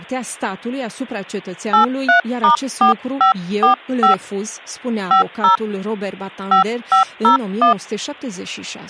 DTMF, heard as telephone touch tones, dialled by hand, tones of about 120 ms, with speech in Romanian. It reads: 83*4545 50 5501